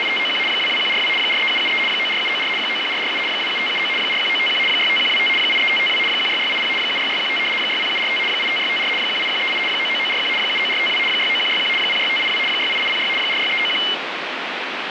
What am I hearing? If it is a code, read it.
RTTY (75 baud, 850 Hz shift), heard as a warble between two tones, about 2550 Hz centre, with radio static. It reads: … 22142 43773 94794 91447 27579 41951 65125 83552 16680 76615 60745 85654 18138 99941 79452 69161 06582 68806 46391